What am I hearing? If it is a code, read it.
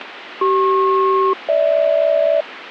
Aircraft SELCAL, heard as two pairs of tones, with radio static. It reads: CP-GH